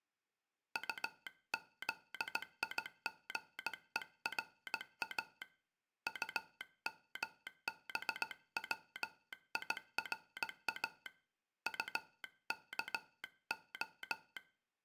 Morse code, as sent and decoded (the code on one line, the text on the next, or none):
..- --.. .. --. . .-. .- / ..- -- -... .-- .. .-. .- / ..- -.- ---
UZIGERA UMBWIRA UKO